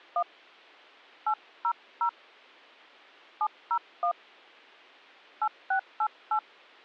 DTMF, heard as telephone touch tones, dialled by hand, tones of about 80 ms. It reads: 1 800 701 8688